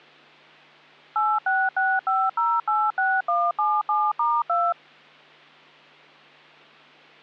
DTMF, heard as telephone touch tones, dialled by machine, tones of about 230 ms. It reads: 8665086177*2